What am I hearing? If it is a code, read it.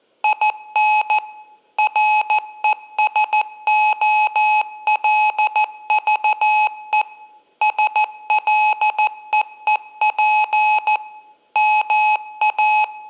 Morse code, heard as electronic beeps, machine-sent, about 14 wpm, 850 Hz, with room echo. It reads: IN RESOLVE SLEEP …